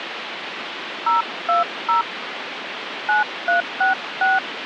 DTMF, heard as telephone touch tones, dialled by hand, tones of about 130 ms, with phone line noise. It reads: 020 9366